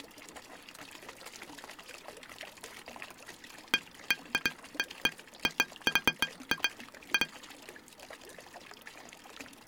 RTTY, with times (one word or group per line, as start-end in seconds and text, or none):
none